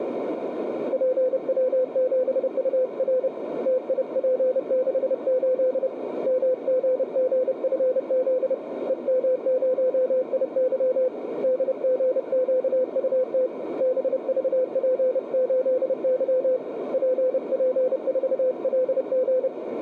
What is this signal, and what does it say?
Morse code, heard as a keyed tone, hand-sent with a paddle, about 30 wpm, 510 Hz, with radio static and a narrow filter. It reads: PW7UR TIP68 MGGFZ EM0IY DGQUT BVP8Y PP4LG